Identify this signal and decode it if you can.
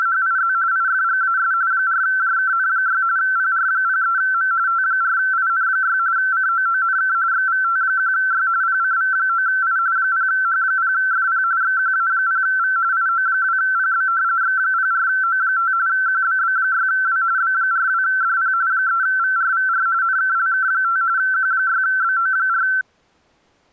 RTTY (45.45 baud, 170 Hz shift), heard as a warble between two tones, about 1440 Hz centre. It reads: … IFGAS 4JKN6 PR03M T4IN6 COONK XVT1Y PCV9I 0H0FP XQA0V IO2PB X04O5 QBB6W B42DP 3VRVR NKLK5 Q6BO4